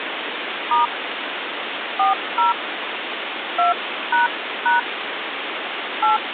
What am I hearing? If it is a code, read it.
DTMF, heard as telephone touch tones, dialled by hand, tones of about 140 ms, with phone line noise. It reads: * 40 2## 8